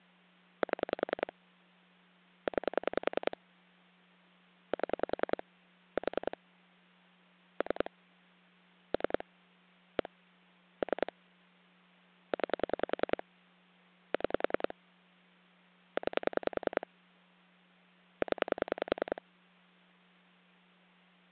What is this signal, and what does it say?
Pulse dialling, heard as clicks on a phone line, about 10 pulses a second, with hum. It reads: 7 9 7 4 3 3 1 3 9 6 9 0